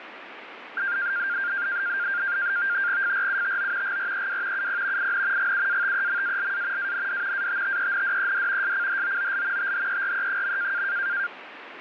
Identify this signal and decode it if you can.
NAVTEX (SITOR-B), 100 baud, 170 Hz shift, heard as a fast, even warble, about 1500 Hz centre, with radio static. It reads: FRUTO GREW UP IN GUATEMALA AND ATTENDED SCHOOL THERE.